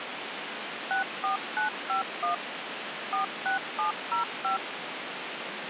DTMF, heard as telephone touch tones, dialled by machine, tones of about 120 ms, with phone line noise. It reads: 64951 46705